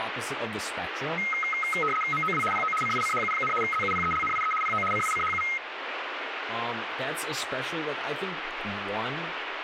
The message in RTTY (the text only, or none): MOW PO CICHU, ZUPELNIE PO CICHU